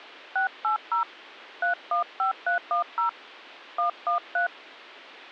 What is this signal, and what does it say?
DTMF, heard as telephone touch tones, dialled by hand, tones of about 120 ms. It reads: 680 315310 113